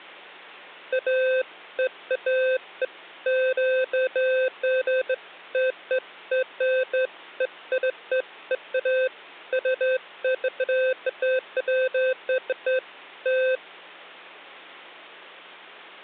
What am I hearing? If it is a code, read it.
Beeps of irregular length, with hum. There is no code.